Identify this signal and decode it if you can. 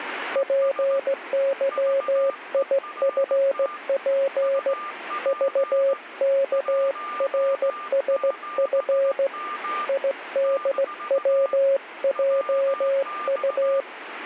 Morse code, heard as a keyed tone, hand-sent with a straight key, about 16 wpm, 550 Hz, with radio static and a weaker station near 1200 Hz. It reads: PYIFP VKRSF IDWJU